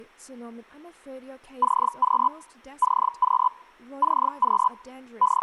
Hellschreiber (Feld-Hell, 122.5 baud), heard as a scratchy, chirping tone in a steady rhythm, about 1000 Hz, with speech in English. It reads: CQ CQ CQ …